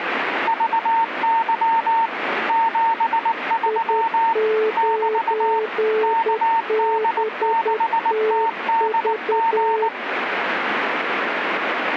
Morse code, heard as two keyed tones, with radio static. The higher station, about 19 wpm, 910 Hz: VY 73 <BT> KD6TDG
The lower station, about 10 wpm, 440 Hz: I9BTV